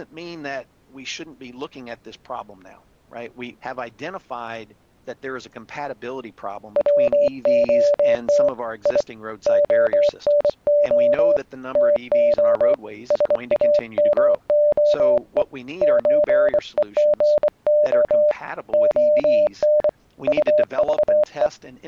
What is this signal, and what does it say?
Morse code (Russian alphabet), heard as a keyed tone, hand-sent with a bug key, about 24 wpm, 590 Hz. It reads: ВОТ И ОНО ТО САМОЕ ЧЕГО ОН УЖЕ